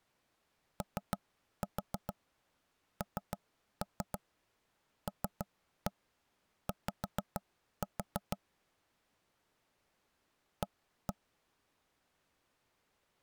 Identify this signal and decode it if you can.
Tap code, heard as knocks on wood, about 6 knocks a second. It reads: ONLY A